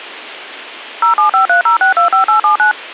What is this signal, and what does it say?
DTMF, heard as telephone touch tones, dialled by machine, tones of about 120 ms. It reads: 07530625879